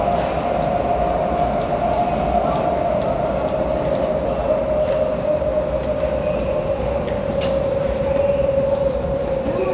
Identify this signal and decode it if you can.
The noise of a subway station. There is no code.